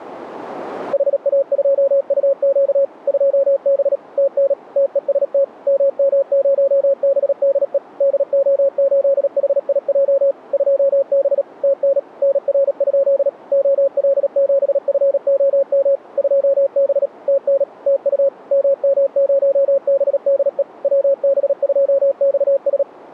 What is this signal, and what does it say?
Morse code, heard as a keyed tone, machine-sent, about 37 wpm, 550 Hz. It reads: HA2UQ 2B TN TEST MM0BDE DO8HIJ 2B TN NR? OL7FOM 2B TN TU MM0BDE WB2XS